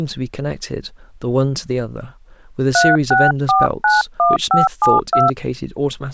DTMF, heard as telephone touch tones, dialled by hand, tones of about 180 ms, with speech in English. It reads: 36491572